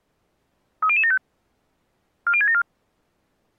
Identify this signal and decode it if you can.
Five-tone selective call (ZVEI), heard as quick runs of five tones, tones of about 70 ms. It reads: 30075 40674